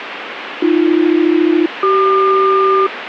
Aircraft SELCAL, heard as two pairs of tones, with radio static. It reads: AB-CQ